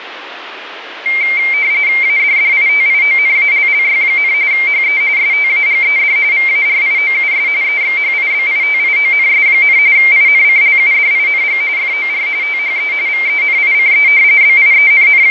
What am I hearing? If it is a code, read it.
RTTY (45.45 baud, 170 Hz shift), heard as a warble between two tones, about 2200 Hz centre, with radio static and fading. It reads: ADDITIONALLY, HE STAGED VARIOUS EXHIBITIONS, INCLUDING FOR THE VENICE …